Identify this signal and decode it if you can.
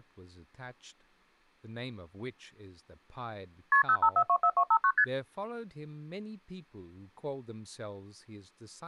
Multi-frequency trunk signalling (R1, as on North American trunks), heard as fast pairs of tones, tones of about 70 ms, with speech in English. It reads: KP 05424259 ST